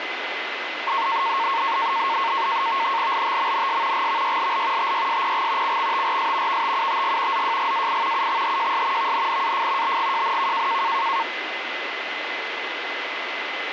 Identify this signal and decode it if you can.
NAVTEX (SITOR-B), 100 baud, 170 Hz shift, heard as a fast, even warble, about 1000 Hz centre, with radio static and a steady whistle near 2030 Hz. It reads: LTMNS GVYLL TYSPG CXTRS VTUTG ZJGAI UXHJS VNNAF BGJNK